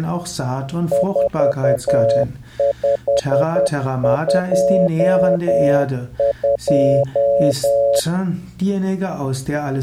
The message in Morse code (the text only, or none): 4522